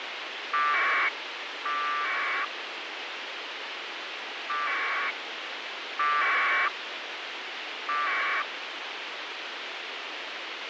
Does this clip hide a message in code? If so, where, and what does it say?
Yes: packet radio (AX.25, as in APRS), 1200 baud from 0.5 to 8.4 s, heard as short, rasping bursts, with radio hiss.